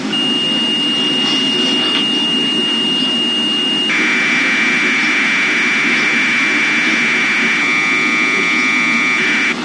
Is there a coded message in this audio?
Yes: Commodore tape loading (standard loader) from 0.1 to 9.5 s, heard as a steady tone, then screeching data, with tape hiss and the noise of a park.